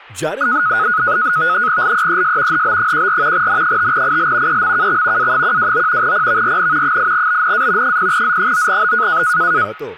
NAVTEX (SITOR-B), 100 baud, 170 Hz shift, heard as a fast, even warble, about 1360 Hz centre, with speech in Gujarati. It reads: LEES HB14 N5IL EMKX A129 PVRN 8BNA 0Z9B